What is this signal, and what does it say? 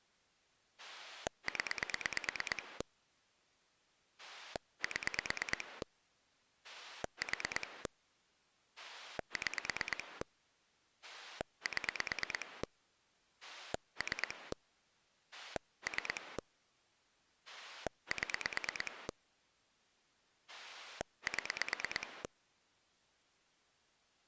Pulse dialling, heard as a rotary dial, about 9 pulses a second. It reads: 0 7 4 6 7 3 3 7 7